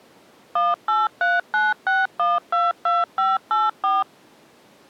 DTMF, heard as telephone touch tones, dialled by machine, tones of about 190 ms. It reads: 18396122584